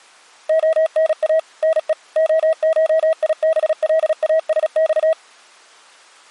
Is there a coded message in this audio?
Yes: Morse code (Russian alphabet) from 0.4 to 5.2 s, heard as a keyed tone, machine-sent, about 36 wpm, 640 Hz. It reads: ОНА НЕ ОШИБЛАСЬ